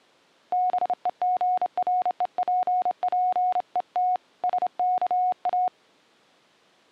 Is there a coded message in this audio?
Yes: Morse code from 0.5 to 5.7 s, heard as a keyed tone, hand-sent with a straight key, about 28 wpm, 730 Hz. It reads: BEGREPPET SKA